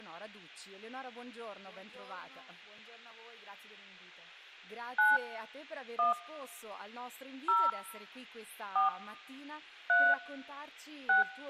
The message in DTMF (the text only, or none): 9 1 0 4 3 6